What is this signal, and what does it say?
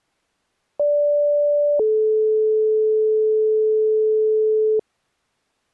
Two-tone page, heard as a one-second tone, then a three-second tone, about 580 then 430 Hz.